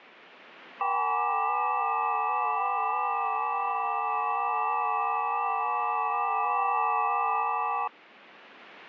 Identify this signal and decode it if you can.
FT8 (several signals at once), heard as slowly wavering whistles, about 6.25 baud.